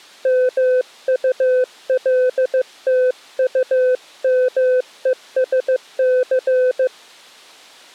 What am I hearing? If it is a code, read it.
Morse code, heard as a keyed tone, hand-sent with a paddle, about 15 wpm, 510 Hz. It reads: MULTUMESC